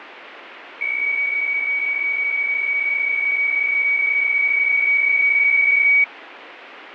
PSK63 (62.5 baud), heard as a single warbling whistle, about 2250 Hz, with radio static.